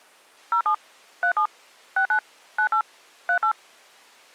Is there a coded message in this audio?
Yes: DTMF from 0.5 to 3.5 s, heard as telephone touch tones, dialled by machine, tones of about 90 ms. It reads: 07 37 69 98 38